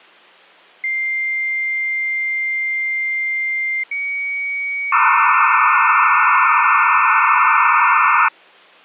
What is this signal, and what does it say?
Dial-up modem handshake (low-speed, two carriers), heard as two whistles, then hiss.